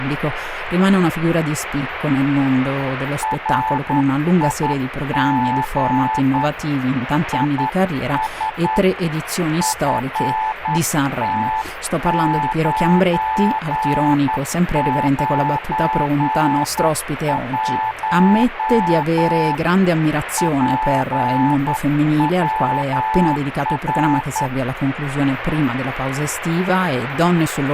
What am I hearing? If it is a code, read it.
Morse code, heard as a keyed tone, hand-sent with a straight key, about 10 wpm, 880 Hz, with radio static. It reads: RIG IS FT991 PWR